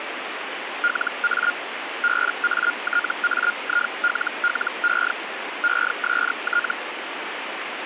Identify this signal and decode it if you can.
Hellschreiber (Feld-Hell, 122.5 baud), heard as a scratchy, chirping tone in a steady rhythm, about 1420 Hz, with radio static. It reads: LA BATAILLE EST